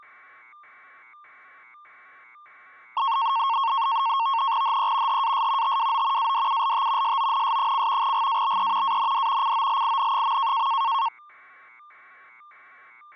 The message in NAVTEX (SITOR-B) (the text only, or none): HE HAS TWO ADULT SONS: GABE AND COLIN.